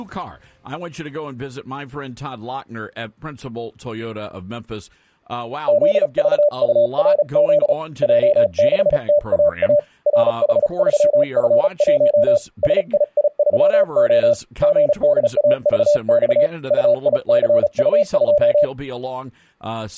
Morse code, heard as a keyed tone, hand-sent with a paddle, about 35 wpm, 590 Hz. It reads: ZVURZ J6TAA RH3F1 SII3O GDAVX UICU2